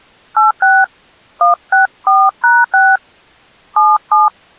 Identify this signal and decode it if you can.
DTMF, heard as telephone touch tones, dialled by hand, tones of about 230 ms. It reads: 86 164#6 77